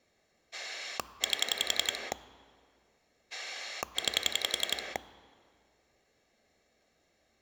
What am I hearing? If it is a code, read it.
Pulse dialling, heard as a rotary dial, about 11 pulses a second. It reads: 8 9